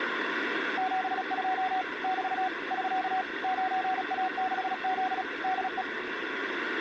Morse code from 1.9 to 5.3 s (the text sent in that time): <BT> <SK> 9A6Z